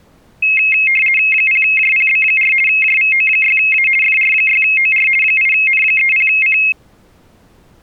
RTTY (50 baud, 450 Hz shift), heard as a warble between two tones, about 2350 Hz centre. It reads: 0JPB4 JVO6A FR6OR 8N30C